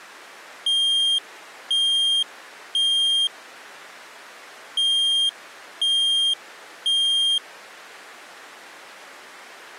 Alarm pattern, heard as an alarm's beeps, played twice, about 3200 Hz. Temporal three. Smoke or fire, evacuate.